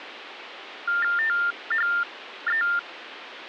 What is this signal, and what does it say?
TTY/TDD text telephone tones (45.45 baud Baudot), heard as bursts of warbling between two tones, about 400 Hz shift, 1600 Hz centre, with phone line noise. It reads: THE